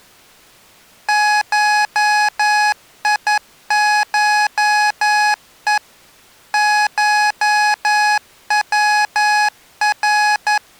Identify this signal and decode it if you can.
Morse code (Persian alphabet), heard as electronic beeps, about 11 wpm, 840 Hz. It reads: شیشه شور